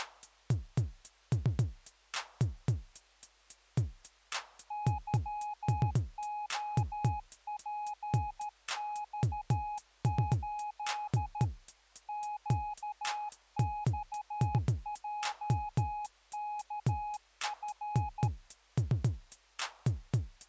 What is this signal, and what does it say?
Morse code, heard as a keyed tone, machine-sent, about 13 wpm, 840 Hz. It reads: YOPX8 QXJKF